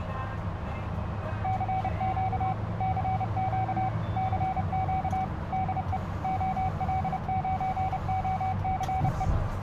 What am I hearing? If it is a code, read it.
Morse code, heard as a keyed tone, machine-sent, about 30 wpm, 760 Hz, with radio static, a narrow filter and the noise inside a car. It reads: CQ CQ CQ DE OL9OCE